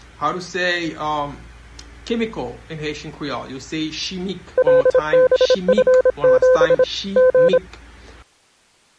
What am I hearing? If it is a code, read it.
Morse code, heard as a keyed tone, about 26 wpm, 510 Hz. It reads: LBF7 G